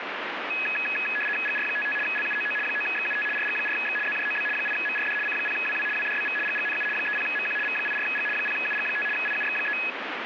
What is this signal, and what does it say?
RTTY (75 baud, 850 Hz shift), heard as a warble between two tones, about 2100 Hz centre, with radio static. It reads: GR55 LUOO 9XUT RG4X ZJOB 8MRD C0WW WDBV GGNU 30MQ V84G 0UG5 IUX3